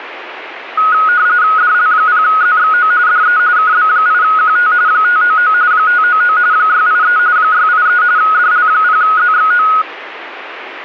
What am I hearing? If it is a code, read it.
RTTY (45.45 baud, 170 Hz shift), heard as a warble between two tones, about 1360 Hz centre, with radio static. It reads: DL0ZXO DE KB8QT 599 599 683 683 DL0ZXO